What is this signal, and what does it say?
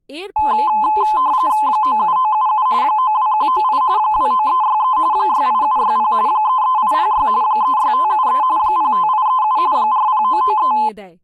RTTY (45.45 baud, 170 Hz shift), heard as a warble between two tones, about 940 Hz centre, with speech in Bangla. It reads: 97977 92198 29363 68760 33806 36573 05837 40993